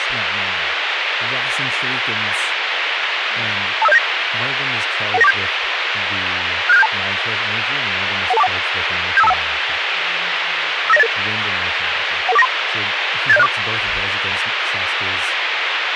Five-tone selective call (EIA), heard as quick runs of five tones, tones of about 30 ms, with radio hiss and speech in English. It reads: 25079 11947 67672 11241 75251 59088 11493 87064